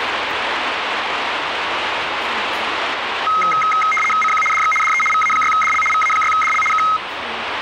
RTTY (75 baud, 850 Hz shift), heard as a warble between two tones, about 1700 Hz centre, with radio static and the noise of a restaurant. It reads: CQ DX DE VA6DL VA6DL K